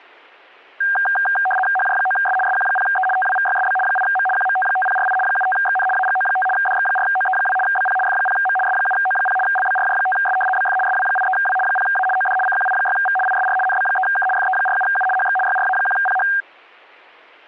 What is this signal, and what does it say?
RTTY (75 baud, 850 Hz shift), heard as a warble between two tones, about 1180 Hz centre. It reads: HJ9S SQ0E TWVYSB 8M QMT5048 75XN AGO5 DX4OE2 BP F0M S7O0 LBRJ5S BF SW83W 0A OD CQI6V ISR NB3K FE47U HX YRA1PH